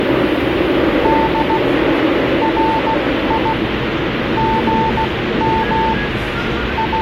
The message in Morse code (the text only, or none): D RI GM …